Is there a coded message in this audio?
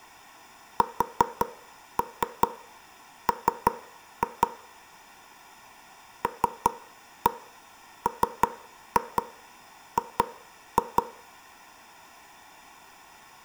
Yes: tap code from 0.8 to 11.0 s, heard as knocks on wood, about 5 knocks a second, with room echo. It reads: SM LMG